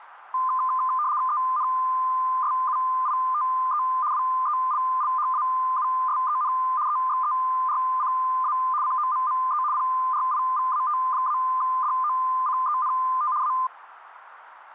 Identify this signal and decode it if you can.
RTTY (75 baud, 170 Hz shift), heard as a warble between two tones, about 1120 Hz centre, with radio static. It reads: ENSUITE WELLHAUSEN EXERCA COMME PRIVAT-DOCENT A